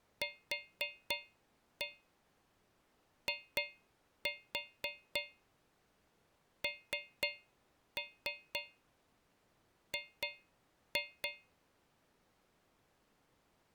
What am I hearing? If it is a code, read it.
Tap code, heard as taps on a metal pipe, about 3 knocks a second. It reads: QING